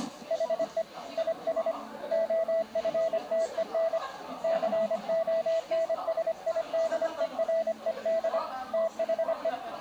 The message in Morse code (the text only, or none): HE IS OFTEN CONSIDERED THE